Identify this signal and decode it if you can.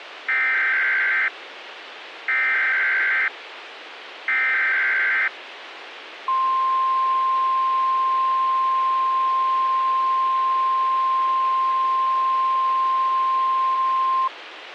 Emergency Alert System (SAME) tones (header bursts, then the 1050 Hz attention tone), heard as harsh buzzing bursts, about 520.83 baud, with radio hiss.